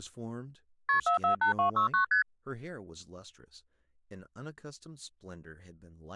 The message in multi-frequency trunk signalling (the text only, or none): KP 448269 ST